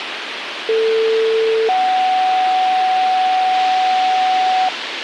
Two-tone page, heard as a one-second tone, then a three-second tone, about 450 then 750 Hz, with radio hiss.